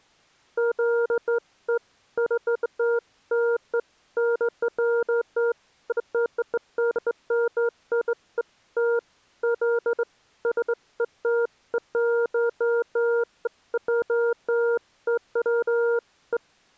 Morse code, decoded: none

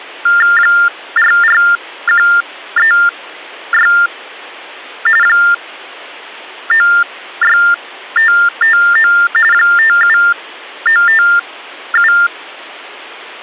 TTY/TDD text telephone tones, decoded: 44136 96559 57957

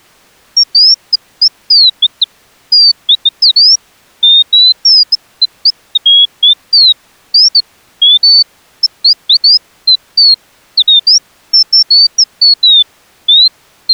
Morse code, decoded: none

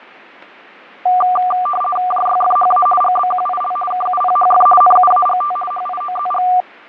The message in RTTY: JYFHA GBQIL KUPHF NUAGT HIOZG

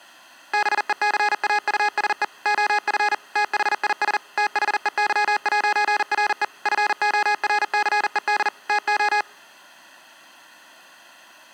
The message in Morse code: BECAUSE OF THIS THEY'RE FORCED TO

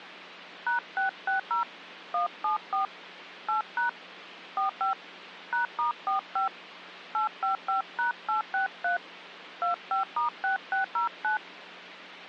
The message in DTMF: #660 174 8# 45 #*45 855#863 25*6609

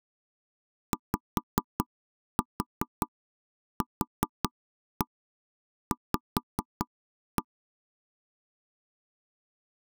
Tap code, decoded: YQV

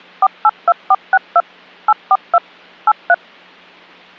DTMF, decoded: 482462 842 83

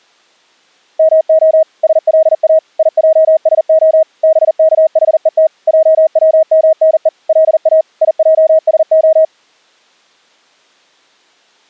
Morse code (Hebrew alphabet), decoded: מה שלא יעשה בכחות עצמנו לא יעשה

